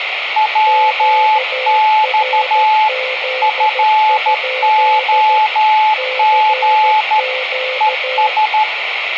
Morse code, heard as two keyed tones, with radio static. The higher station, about 13 wpm, 860 Hz: WX FOG ES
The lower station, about 14 wpm, 520 Hz: QRZ? CQ